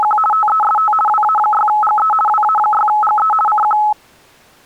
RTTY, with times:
0.0-0.2 …
0.3-0.9 TEST
1.1-2.1 WA6GE
2.3-3.3 WA6GE
3.5-3.8 CQ

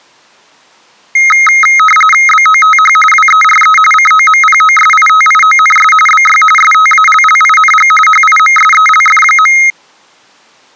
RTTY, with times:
2.3-3.0 BOTH
3.1-3.8 WERE
3.9-5.9 COMPOSITIONS
6.1-6.4 BY
6.6-7.9 STALLING
8.1-9.6 HIMSELF.

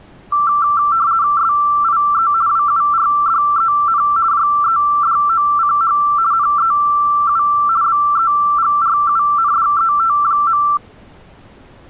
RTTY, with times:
1.4-2.3 SIE
2.5-4.0 WURDEN
4.3-6.0 JEDOCH
6.3-7.4 NEU
7.8-10.6 BEGRUNDET.

